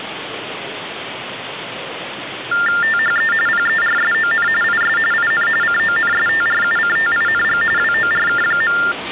TTY/TDD text telephone tones (45.45 baud Baudot), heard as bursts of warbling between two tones, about 400 Hz shift, 1600 Hz centre, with phone line noise and the noise of a subway station. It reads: THE PERSON IS IN CONSTRUCTING WORK.